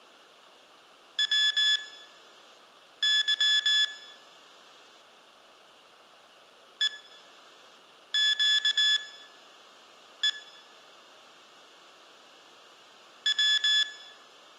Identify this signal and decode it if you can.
Morse code (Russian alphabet), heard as electronic beeps, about 19 wpm, spaced as for 6 wpm, 1700 Hz, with room echo. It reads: ВЫ ЕЩЕ В